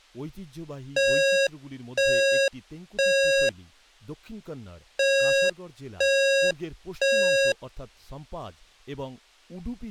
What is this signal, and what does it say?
Alarm pattern, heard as an alarm's beeps, played twice, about 550 Hz, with speech in Bangla. Temporal three. Smoke or fire, evacuate.